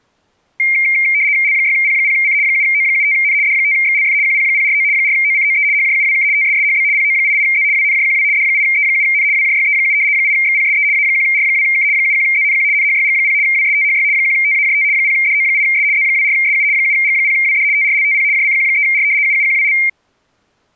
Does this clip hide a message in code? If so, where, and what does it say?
Yes: RTTY (75 baud, 170 Hz shift) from 0.6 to 19.9 s, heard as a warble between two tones, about 2200 Hz centre. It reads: L6P0C 7O75N D5XLF QP049 4OCOE HJUWK TSSHB PO88Z WNJQW D8E7N WJYE7 8XPSE A1R2K 71ZNQ NHYG0 WSTHY 1TAJT 0DO8S Z24SU 7G0WD TRLTP JCQ3R UUQWL